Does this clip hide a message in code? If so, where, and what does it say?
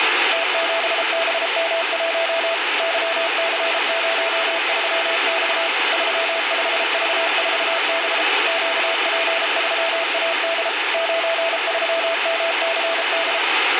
Yes: Morse code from 0.3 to 13.4 s, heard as a keyed tone, machine-sent, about 33 wpm, 660 Hz, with radio static. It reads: T7BM1 YC03X 35V4B QP3AD 93MCD